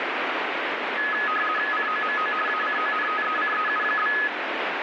RTTY (50 baud, 450 Hz shift), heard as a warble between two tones, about 1480 Hz centre, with radio static. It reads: COMO ACONTECEU?